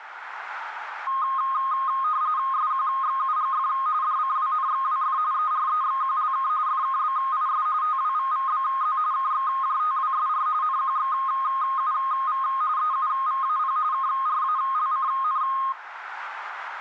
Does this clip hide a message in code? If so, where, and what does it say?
Yes: RTTY (45.45 baud, 170 Hz shift) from 1.1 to 15.7 s, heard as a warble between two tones, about 1160 Hz centre, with radio static and room echo. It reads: SQXUGF DCWNXWF EREXQLK FKBIS TWVVBZ KXJTWSR NQXUV EUVAP KRALCN